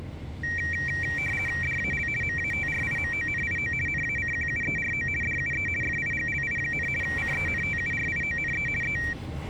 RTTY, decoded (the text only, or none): DAL MATRIMONIO NACQUERO DUE FIGLI, CENTURIONE E